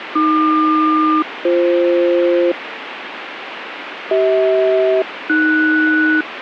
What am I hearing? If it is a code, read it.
Aircraft SELCAL, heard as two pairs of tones, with radio static. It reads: AQ-BF CH-AS